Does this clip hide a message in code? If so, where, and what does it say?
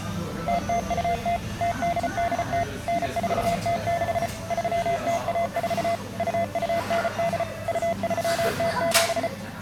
Yes: Morse code (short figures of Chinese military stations) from 0.4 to 9.3 s, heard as a keyed tone, machine-sent, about 34 wpm, 680 Hz, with the noise of a restaurant. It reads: 0020 0880 9406 3014 2298 2307